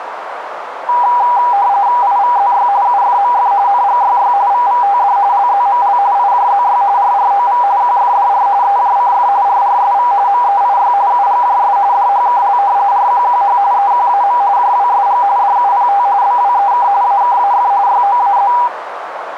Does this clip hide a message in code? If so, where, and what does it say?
Yes: RTTY (45.45 baud, 170 Hz shift) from 0.9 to 18.7 s, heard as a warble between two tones, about 890 Hz centre, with radio static and a narrow filter. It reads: IVZY UFMF NGYY VVTD LZML IJZY RROV QFDR EJCF RRSV MEIY UGJS DHKL RQQH EQAM JWSG DUPT BWEK AKAF YOAZ